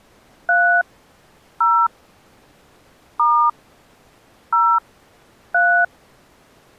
DTMF, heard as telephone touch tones, dialled by hand, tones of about 280 ms. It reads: 3 0 * 0 3